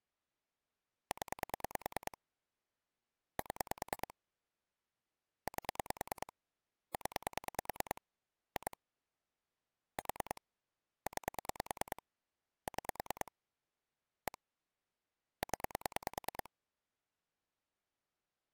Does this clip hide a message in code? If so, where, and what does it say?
Yes: pulse dialling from 1.1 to 16.5 s, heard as clicks on a phone line, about 9 pulses a second. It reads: 0 7 8 0 2 4 9 6 1 0